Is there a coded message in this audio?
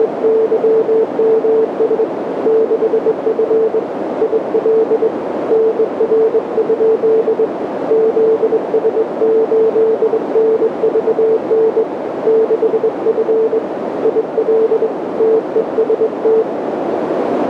Yes: Morse code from 0.0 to 16.5 s, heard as a keyed tone, hand-sent with a straight key, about 22 wpm, 440 Hz, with radio static and a narrow filter. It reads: … 6F IL NR? ZS8NVN 6F IL TEST